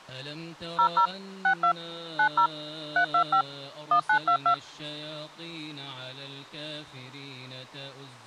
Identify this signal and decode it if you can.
DTMF, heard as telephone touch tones, dialled by machine, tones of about 90 ms. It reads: 00 62 90 325 1922